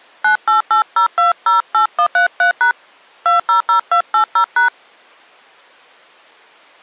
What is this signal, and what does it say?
DTMF, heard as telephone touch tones, dialled by hand, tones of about 110 ms. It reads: 9880208133# 200280#